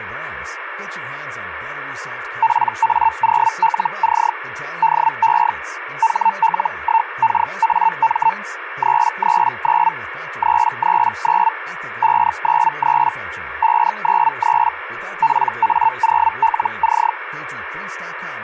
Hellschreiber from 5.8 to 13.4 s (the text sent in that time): HL1KAM 339 339 593